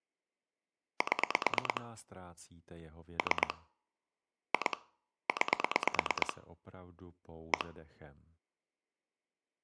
Pulse dialling, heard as clicks on a phone line, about 9 pulses a second, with speech in Czech. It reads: 7 3 2 9 1